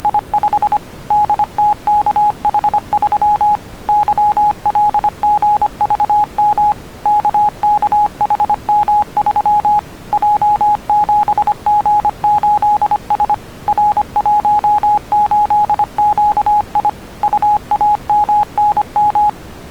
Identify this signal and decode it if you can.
Morse code, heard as a keyed tone, machine-sent, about 25 wpm, 840 Hz. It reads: … DTKH3 YLGVM KKHM3 J7G8S R18QI UAMNM